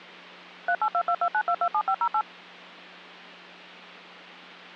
DTMF, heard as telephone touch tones, dialled by machine, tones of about 70 ms, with hum. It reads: 382229227508